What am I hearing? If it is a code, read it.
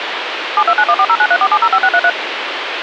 DTMF, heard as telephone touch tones, dialled by machine, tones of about 60 ms, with phone line noise. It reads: 729140934705633